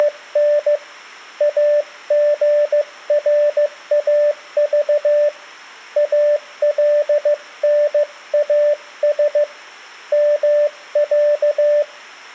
Morse code (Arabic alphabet), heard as a keyed tone, hand-sent with a paddle, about 15 wpm, 590 Hz. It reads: … اغراض الناس مع